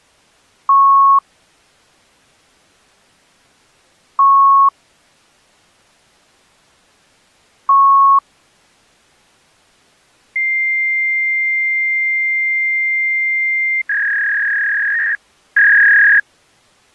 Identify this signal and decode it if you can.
Fax machine handshake, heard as beeps, a long tone and a warble.